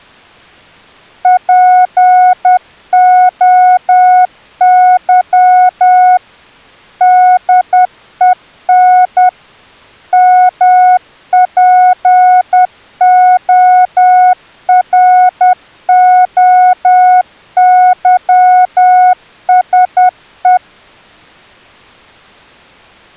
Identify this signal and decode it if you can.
Morse code (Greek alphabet), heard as a keyed tone, machine-sent, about 10 wpm, 730 Hz. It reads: ΠΟΥ ΔΕΝ ΜΠΟΡΟΥΣΕ